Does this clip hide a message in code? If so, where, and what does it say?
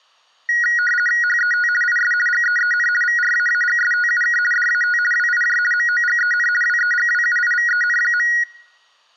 Yes: RTTY (50 baud, 450 Hz shift) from 0.5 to 8.4 s, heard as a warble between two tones, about 1700 Hz centre. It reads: HET IS GEEN VRAAGSTUK DAT WIJ MOGEN WEGWUIVEN.